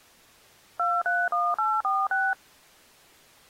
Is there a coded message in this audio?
Yes: DTMF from 0.8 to 2.3 s, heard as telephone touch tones, dialled by machine, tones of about 220 ms. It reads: 231846